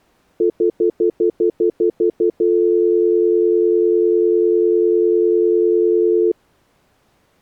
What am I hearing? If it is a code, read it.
Telephone call progress tone (North American plan), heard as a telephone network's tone, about 350, 440 Hz, 0.1 s on and 0.1 s off. Stutter dial tone.